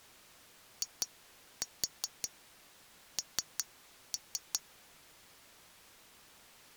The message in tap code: IN

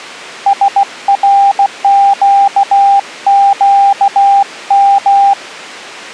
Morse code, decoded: SRQQM

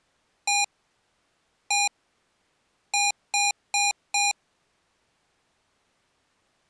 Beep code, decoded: 1-1-4

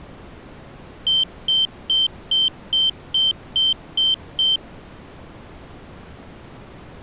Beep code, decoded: 9 short

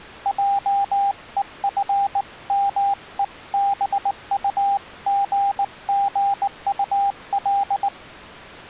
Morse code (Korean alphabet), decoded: 한마디씩

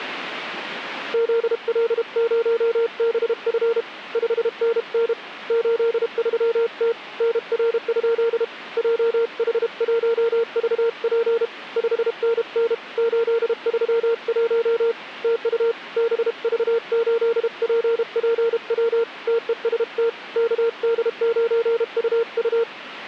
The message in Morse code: ZL0BF 5NN 83T NR? JH1VP 5NN 831 TU BV8PPW TEST KD9UU

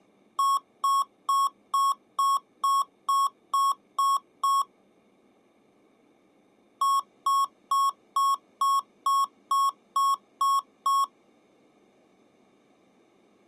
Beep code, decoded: 10 short

